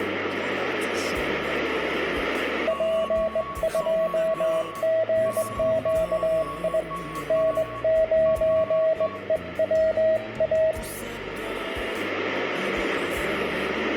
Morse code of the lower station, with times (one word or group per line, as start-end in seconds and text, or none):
2.7-6.8 P2GQI
7.3-10.7 N9EWA